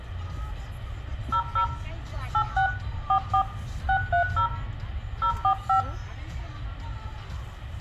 DTMF, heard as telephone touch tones, dialled by hand, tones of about 90 ms, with room echo and the noise inside a car. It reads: 00 86 44 630 045